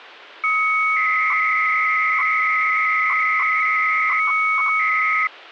300-baud modem data (Bell 103 tones), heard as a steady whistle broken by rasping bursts, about 300 baud, 200 Hz shift.